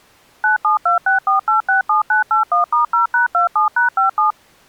DTMF, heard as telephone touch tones, dialled by machine, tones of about 130 ms. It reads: 97264867981*0#27#57